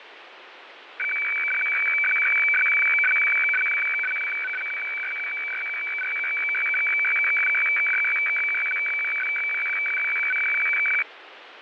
Weather fax (radiofax), 120 lines a minute, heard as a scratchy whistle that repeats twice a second, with radio static and fading.